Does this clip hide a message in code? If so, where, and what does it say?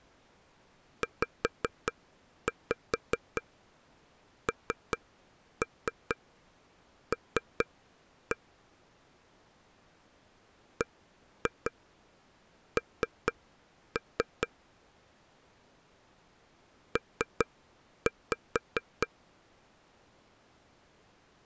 Yes: tap code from 1.0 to 19.1 s, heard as taps on a table, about 4 knocks a second. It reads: ZNL BN P